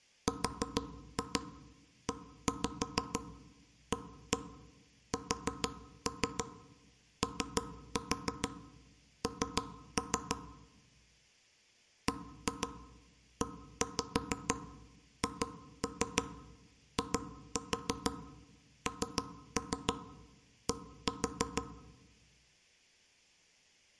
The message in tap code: REASON BEHIND

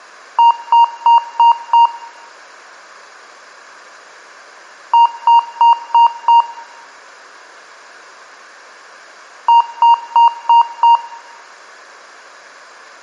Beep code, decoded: 5 short

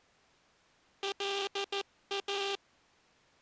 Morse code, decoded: LA

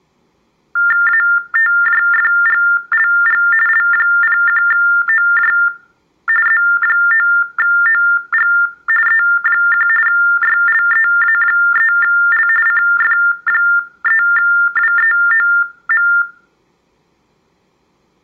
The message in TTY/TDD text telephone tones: ATJFGLG L01OJ Z9OG E1 YLEA3L CF3WEOM

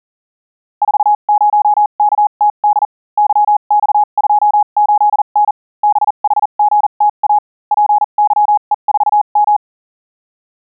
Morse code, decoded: 40KTD YX28N BHGTA PYE4M

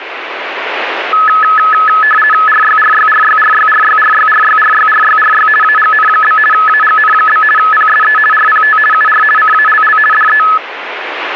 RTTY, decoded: RYRYRYRYRYRYRYRYRYRY AGN? AGN? PSE RPT UR CALL DE

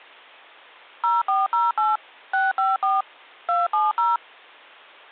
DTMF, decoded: 0408 654 270

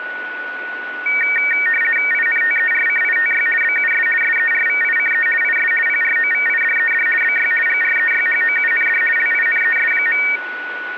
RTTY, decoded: INTERCITY BUS SERVICE IS PROVIDED BY GREYHOUND LINES.

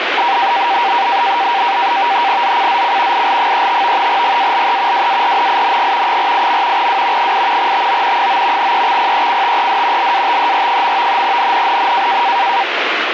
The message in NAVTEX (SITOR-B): ZCZC IL35 GALE WARNING 48. W 8 TO 9 EXPECTED LATER. NNNN

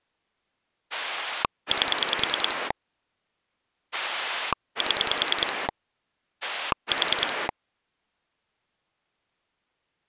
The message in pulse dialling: 8 7 4

